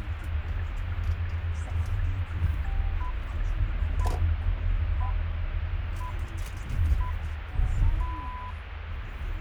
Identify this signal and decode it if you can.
Radio time signal (six pips, as the Greenwich Time Signal), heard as pips, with radio static and the noise inside a car.